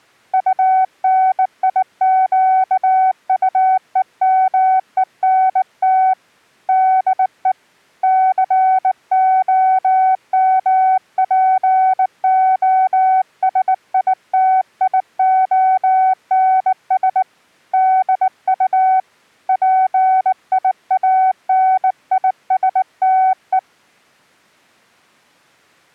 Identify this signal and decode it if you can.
Morse code, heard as a keyed tone, hand-sent with a bug key, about 19 wpm, 750 Hz. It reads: UNIQUEMENT DE COMPOSITIONS DU PIANISTE